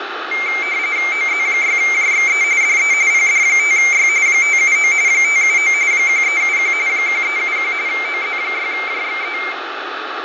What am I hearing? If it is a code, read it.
RTTY (45.45 baud, 170 Hz shift), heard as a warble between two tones, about 2200 Hz centre, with radio static, fading and room echo. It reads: OZ6JXE DE PD5Y 579 579 1371 1371 OZ6JXE